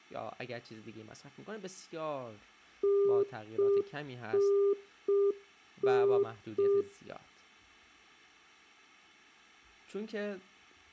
Telephone call progress tone (UK plan), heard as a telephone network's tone, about 400 Hz, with speech in Persian. Congestion tone.